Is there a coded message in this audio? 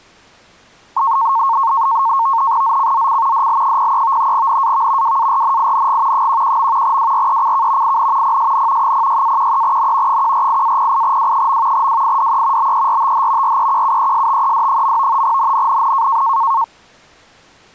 Yes: NAVTEX (SITOR-B), 100 baud, 170 Hz shift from 1.0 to 16.6 s, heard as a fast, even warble, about 1000 Hz centre. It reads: ZCZC DL03 NAV WARNING 11. WRECK IN PSN 06-13N 148-08W. WIDE BERTH REQUESTED. NNNN